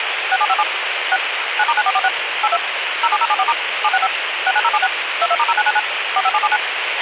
DTMF, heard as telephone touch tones, dialled by machine, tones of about 50 ms, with radio hiss and a squelch burst at the end. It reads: 6757 6 9*9446 82 07074* 765 69076 22*0999 45779